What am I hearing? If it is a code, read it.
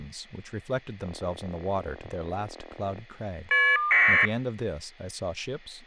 Caller ID data burst, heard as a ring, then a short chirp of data, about 1200 baud, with speech in English.